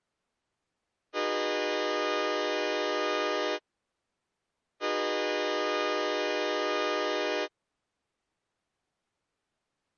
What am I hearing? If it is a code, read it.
Train horn signal, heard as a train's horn. 2 long. On North American railways: brakes released, proceed.